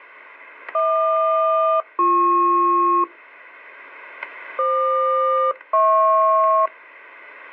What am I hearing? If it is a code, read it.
Aircraft SELCAL, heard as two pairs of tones, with static crashes. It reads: HQ-BP FQ-HP